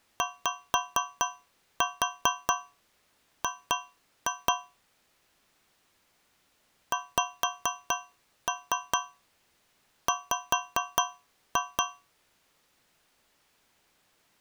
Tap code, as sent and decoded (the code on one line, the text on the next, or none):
5-4 2-2 / 5-3 5-2
YG XW